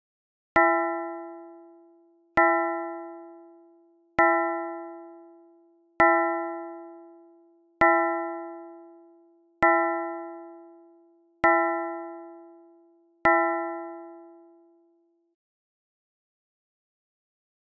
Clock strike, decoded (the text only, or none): 8